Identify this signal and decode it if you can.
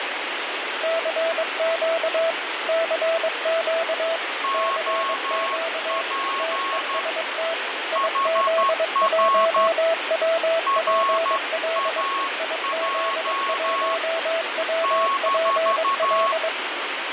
Morse code, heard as two keyed tones, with heavy radio static and fading. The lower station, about 22 wpm, 660 Hz: CQ CQ CQ TEST IZ1WPL IZ1WPL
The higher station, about 12 wpm, 1100 Hz: OP HR RAJ -